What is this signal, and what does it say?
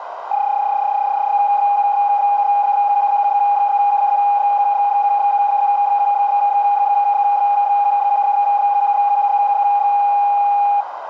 PSK31 (31.25 baud), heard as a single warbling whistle, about 810 Hz, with radio static and a narrow filter.